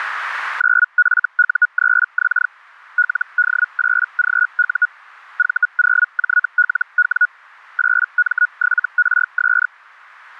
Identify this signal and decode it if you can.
Hellschreiber (Feld-Hell, 122.5 baud), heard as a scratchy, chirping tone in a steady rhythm, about 1460 Hz. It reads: 9FU3X LD8GU V0JLW 8M7RS